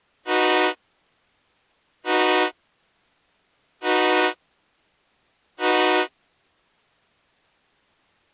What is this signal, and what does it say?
Train horn signal, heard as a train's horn. 4 short. On North American railways: a request for a signal to be given or repeated.